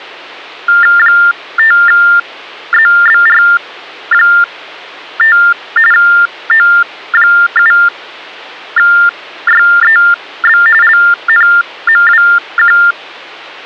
TTY/TDD text telephone tones (45.45 baud Baudot), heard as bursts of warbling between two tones, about 400 Hz shift, 1600 Hz centre, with hum. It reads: 5ZBR5 O7YEB LNMWQ